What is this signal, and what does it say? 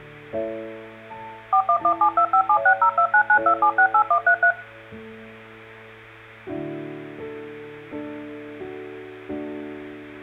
DTMF, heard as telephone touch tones, dialled by machine, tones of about 80 ms. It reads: 4117257602992768133